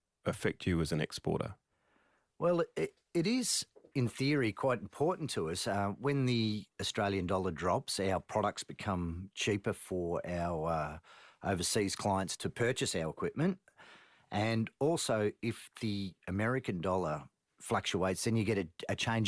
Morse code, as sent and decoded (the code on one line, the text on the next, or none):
none